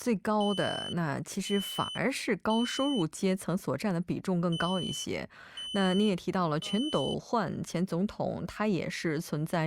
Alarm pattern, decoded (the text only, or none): temporal three